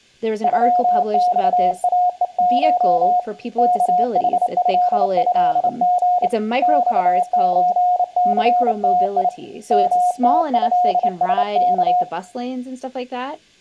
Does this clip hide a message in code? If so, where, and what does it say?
Yes: Morse code (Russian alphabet) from 0.4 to 12.1 s, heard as a keyed tone, hand-sent with a straight key, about 28 wpm, 720 Hz, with room echo and speech in English. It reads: ЮЬАЕШ КХЭЭГ ЬЧЦТИ МТЭСК